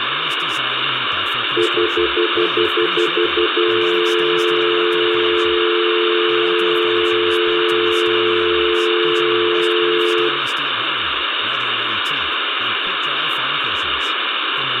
Telephone call progress tone (North American plan), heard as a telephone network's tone, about 350, 440 Hz, 0.1 s on and 0.1 s off, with phone line noise, room echo and speech in Czech. Stutter dial tone.